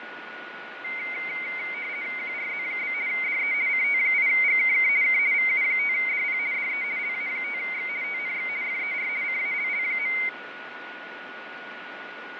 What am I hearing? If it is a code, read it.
RTTY (50 baud, 170 Hz shift), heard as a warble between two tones, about 2150 Hz centre, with radio static, fading and a steady whistle near 1460 Hz. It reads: QRZ? DE CT8GKK K VU5DP DE LA5X TNX FER CALL.